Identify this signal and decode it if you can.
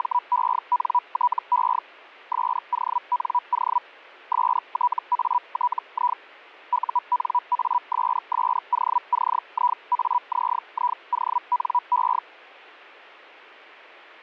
Hellschreiber (Feld-Hell, 122.5 baud), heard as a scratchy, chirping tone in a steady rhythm, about 980 Hz. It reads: … SONO STATI UNASSOCIAZIONE